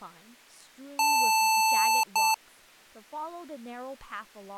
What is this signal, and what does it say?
Beep code, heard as beeps from a small speaker, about 880 Hz, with speech in English. 1 long, 1 short. In IBM BIOS tables: system board problem.